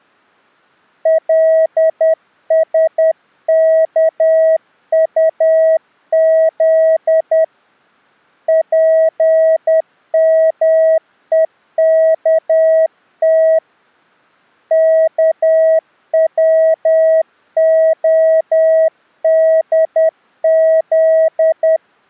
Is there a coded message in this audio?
Yes: Morse code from 1.0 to 21.8 s, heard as a keyed tone, hand-sent with a paddle, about 10 wpm, 640 Hz. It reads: LSKUZ PMEKT KWODZ